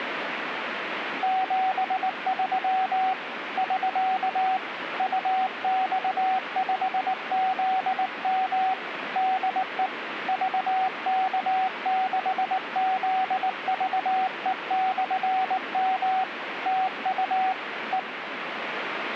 Morse code, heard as a keyed tone, hand-sent with a paddle, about 19 wpm, 760 Hz, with radio static. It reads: 73 <SK> UX5ZM DE VK6ZVE/M TU E